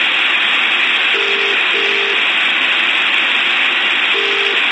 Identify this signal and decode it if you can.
Telephone call progress tone (as in the UK, Ireland, Australia and similar networks), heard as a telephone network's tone, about 400, 450 Hz, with phone line noise. Ringback tone.